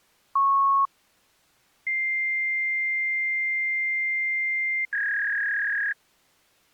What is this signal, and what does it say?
Fax machine handshake, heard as a beep, a long tone and a warble.